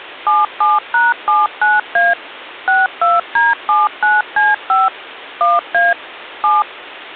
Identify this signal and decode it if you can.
DTMF, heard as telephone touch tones, dialled by machine, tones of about 180 ms. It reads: 77#79A 62D79C5 1A 7